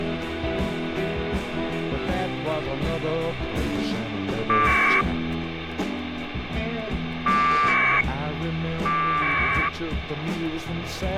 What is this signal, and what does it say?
Packet radio (AX.25, as in APRS), 1200 baud, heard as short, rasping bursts, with radio hiss.